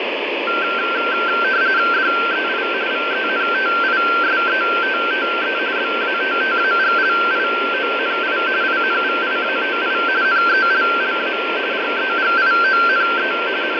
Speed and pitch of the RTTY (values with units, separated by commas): 45.45 baud, 170 Hz shift, 1460 Hz centre